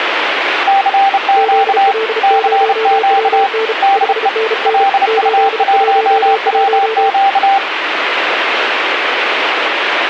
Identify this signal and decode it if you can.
Morse code, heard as two keyed tones, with radio static. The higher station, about 30 wpm, 790 Hz: CQ CQ DE LU1WQ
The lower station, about 35 wpm, 440 Hz: ZL0WN 5NN 811